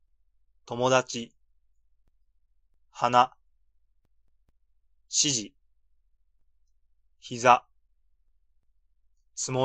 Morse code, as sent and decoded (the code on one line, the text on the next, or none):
none